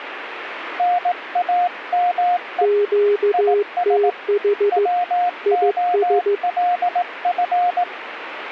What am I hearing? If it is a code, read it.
Morse code, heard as two keyed tones, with radio static. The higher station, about 18 wpm, 710 Hz: NAME IS WOLF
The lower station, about 15 wpm, 410 Hz: QTH IS